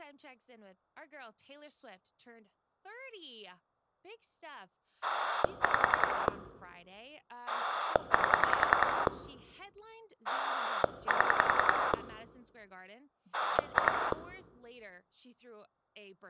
Pulse dialling, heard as a rotary dial, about 10 pulses a second, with speech in English. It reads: 5 8 7 2